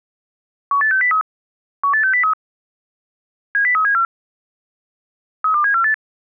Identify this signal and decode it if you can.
Five-tone selective call (CCIR), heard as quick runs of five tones, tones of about 100 ms. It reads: 18603 18603 70374 32748